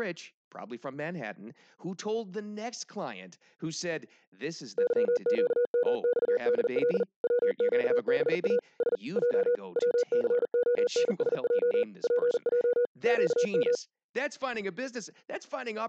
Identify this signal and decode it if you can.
Morse code, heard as a keyed tone, machine-sent, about 40 wpm, 490 Hz, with speech in English. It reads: YQMXDL WQBA S J WCONSJ PJ QM